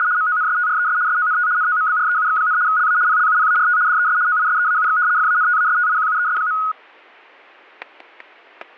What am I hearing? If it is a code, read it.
RTTY (75 baud, 170 Hz shift), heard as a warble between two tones, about 1360 Hz centre, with static crashes. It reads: … MONSTRES SONT NOMBREUX, LA PLUPART DES OISEAUX FANTASTIQUES.